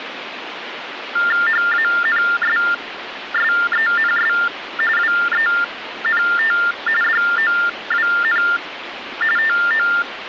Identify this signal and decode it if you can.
TTY/TDD text telephone tones (45.45 baud Baudot), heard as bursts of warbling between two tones, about 400 Hz shift, 1600 Hz centre, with phone line noise. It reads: HANSSENS WENT DOWN TO